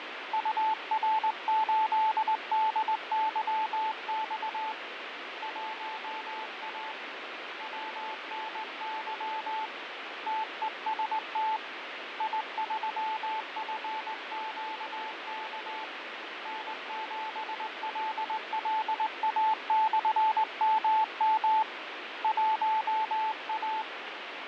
Morse code, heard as a keyed tone, hand-sent with a straight key, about 19 wpm, 880 Hz, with heavy radio static and fading. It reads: UR8DYX 1A WNY TEST I3FQK N7LLA/MM 1A